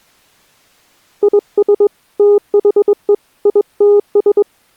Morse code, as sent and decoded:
.. ... / - .... . / .. - ...
IS THE ITS

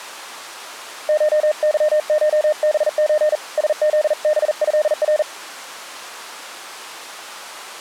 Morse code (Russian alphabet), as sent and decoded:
---- -.-- ---- -... ---. / ... --.. -... ..-.. .-.
ШЫШБЧ СЗБЭР

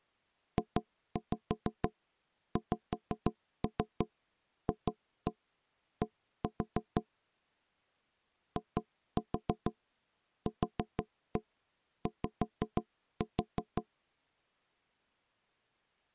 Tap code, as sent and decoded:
2-5 5-3 2-1 1-4 / 2-4 4-1 5-4
JXFD IQY

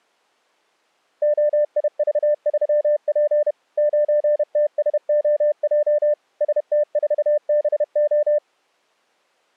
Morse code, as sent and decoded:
--- .. ...- ...-- .--. / ----. - ... --- .--- / ... - ....- -... ---
OIV3P 9TSOJ ST4BO

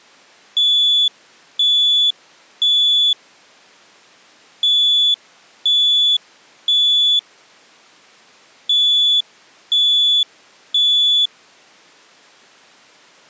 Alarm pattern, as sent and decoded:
3 beeps and a pause
temporal three

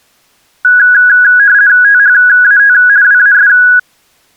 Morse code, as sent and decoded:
none

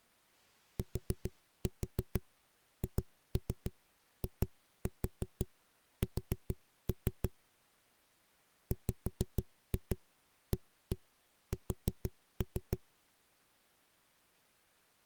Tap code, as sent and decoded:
4-4 2-3 2-4 4-3 / 5-2 1-1 4-3
THIS WAS

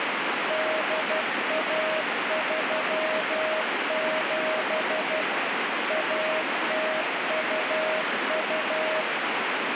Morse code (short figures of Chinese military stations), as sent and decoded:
-.. .- ...-- --... / .- - ..- ..-
8137 1022

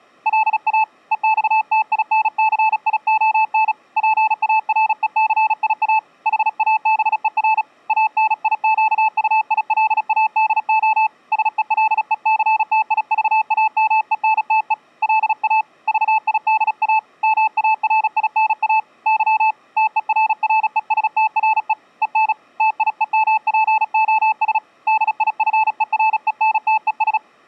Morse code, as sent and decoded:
.-.. .- / . -..- - .. -. -.-. .. --- -. / .--. .- .-. . -.-. .. .- / .... .- -... . .-. / .- -. .. --.- ..- .. .-.. .- -.. --- / ... . .-.. . -.-. - .. ...- .- -- . -. - . / .-.. .- / ...- .. -.. .- / -- .- .-. .. -. .- / -.-- / - . .-. .-. . ... - .-. . / . -. / - .. . -- .--. --- ... / -.. .. ..-. . .-. . -. - . ...
LA EXTINCION PARECIA HABER ANIQUILADO SELECTIVAMENTE LA VIDA MARINA Y TERRESTRE EN TIEMPOS DIFERENTES

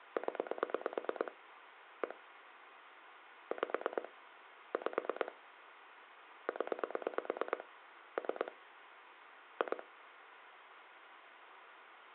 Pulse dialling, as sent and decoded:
10 / 1 / 5 / 5 / 10 / 3 / 2
0 1 5 5 0 3 2

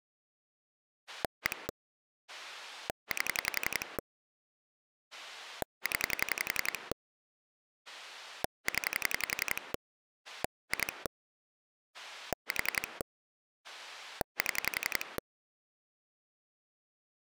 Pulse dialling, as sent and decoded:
1 / 8 / 10 / 10 / 2 / 4 / 7
1 8 0 0 2 4 7

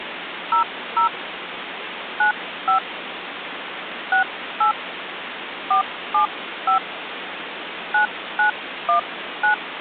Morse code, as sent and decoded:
none

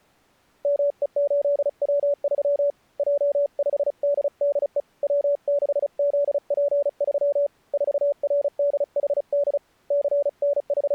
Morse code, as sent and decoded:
-- . ---.. .-- ...-- / .--- ..... -.. -.. . / .-- -.... --.. .--. ...-- / ....- .-. -.. .... -.. / …
ME8W3 J5DDE W6ZP3 4RDHD …

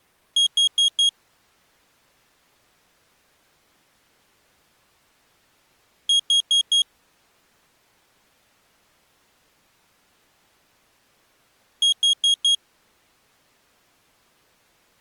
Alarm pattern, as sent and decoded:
4 beeps and a pause
temporal four

